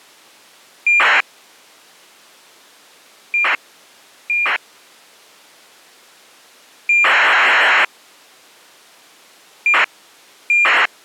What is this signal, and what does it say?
ACARS aircraft data, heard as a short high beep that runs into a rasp, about 2400 baud.